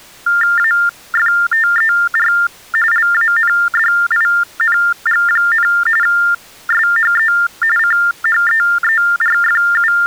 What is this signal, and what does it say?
TTY/TDD text telephone tones (45.45 baud Baudot), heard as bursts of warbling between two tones, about 400 Hz shift, 1600 Hz centre. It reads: AFTER LANDING, SHE …